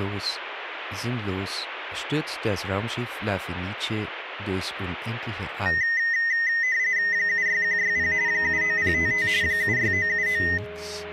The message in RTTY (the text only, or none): 76160 79055 76979